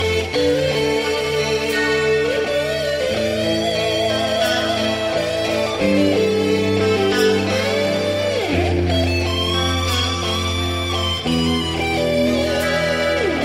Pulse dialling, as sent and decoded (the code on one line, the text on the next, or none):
none